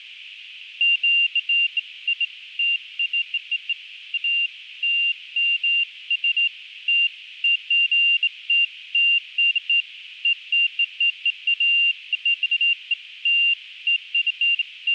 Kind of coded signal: none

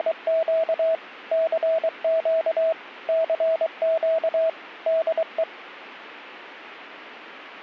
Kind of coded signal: Morse code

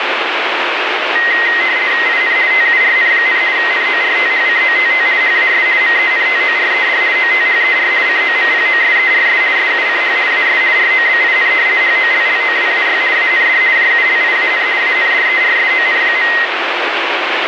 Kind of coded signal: RTTY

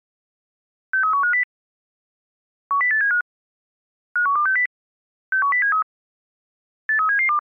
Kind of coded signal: five-tone selective call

